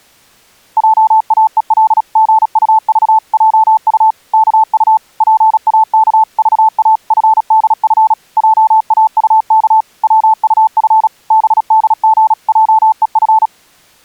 Morse code (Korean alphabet), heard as a keyed tone, machine-sent, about 36 wpm, 880 Hz. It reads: 확실히 이 종로는 횡 빈 듯한